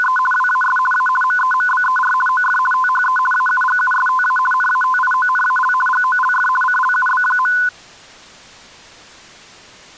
RTTY (50 baud, 450 Hz shift), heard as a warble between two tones, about 1250 Hz centre. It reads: … WAS A MEMBER OF THE AUGUSTA NATIONAL GOLF CLUB.